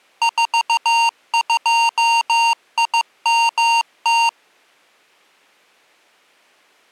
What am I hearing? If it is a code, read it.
Morse code, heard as electronic beeps, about 15 wpm, 920 Hz. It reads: 42IMT